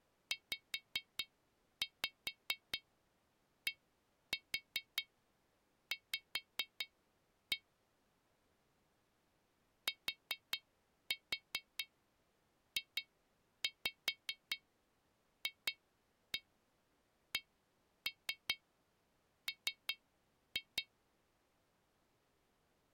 Tap code, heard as taps on glass, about 4 knocks a second. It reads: ZDV TJFCM